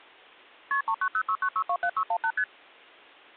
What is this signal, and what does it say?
Multi-frequency trunk signalling (R1, as on North American trunks), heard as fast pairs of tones, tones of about 70 ms. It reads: KP 39069627618 ST